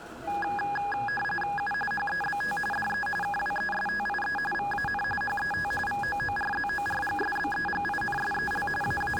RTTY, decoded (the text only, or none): U HEBT DE KWESTIE VAN HET VOORZORGSBEGINSEL …